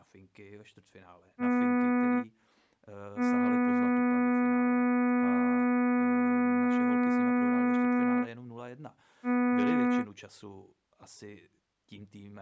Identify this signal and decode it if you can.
Ship horn signal, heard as a ship's horn, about 250 Hz, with speech in Czech. 1 short, 1 long, 1 short. At sea: a vessel at anchor warns of its position.